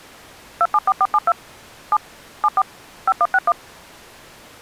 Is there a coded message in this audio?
Yes: DTMF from 0.6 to 3.5 s, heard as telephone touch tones, dialled by machine, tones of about 50 ms. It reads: 274472 7 74 5161